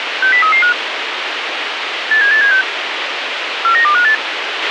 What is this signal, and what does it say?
Five-tone selective call (CCIR), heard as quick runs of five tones, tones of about 100 ms, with radio hiss and a squelch burst at the end. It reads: 60335 87876 49258